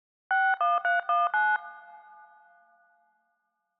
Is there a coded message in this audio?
Yes: DTMF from 0.3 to 1.6 s, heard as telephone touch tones, dialled by hand, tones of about 250 ms. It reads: 61319